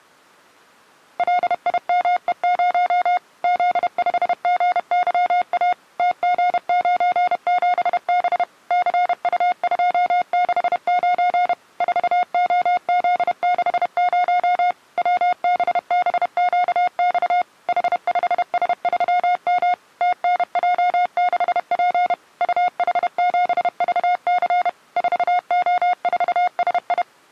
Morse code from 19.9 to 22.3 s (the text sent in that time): TNJ6P